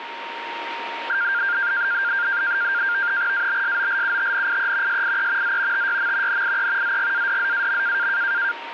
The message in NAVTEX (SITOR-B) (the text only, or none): ABSOLUTNIE SIE Z TYM NIE ZGADZAM